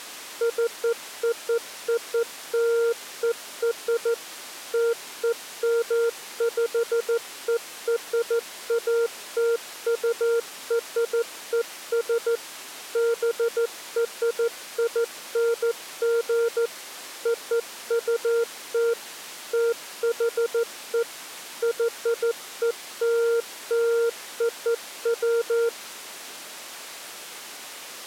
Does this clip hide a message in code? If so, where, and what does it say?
Yes: Morse code (American railroad code) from 0.4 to 25.7 s, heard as a keyed tone, machine-sent, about 460 Hz. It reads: COOLER TEMPERATURES BRING OUT THE YELLOW